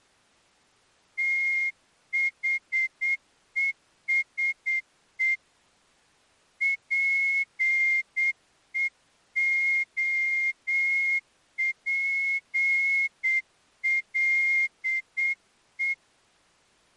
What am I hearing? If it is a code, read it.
Morse code, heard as a whistle, hand-sent with a straight key, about 8 wpm. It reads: THESE PEOPLE